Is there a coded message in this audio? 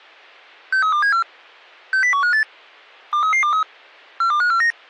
Yes: five-tone selective call (CCIR) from 0.7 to 4.7 s, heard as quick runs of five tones, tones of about 100 ms. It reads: 63274 60158 23323 42549